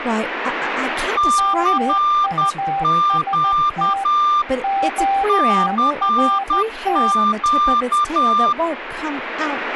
Morse code, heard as two keyed tones, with speech in English. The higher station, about 10 wpm, 1190 Hz: CQ CQ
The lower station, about 14 wpm, 790 Hz: MUST QRT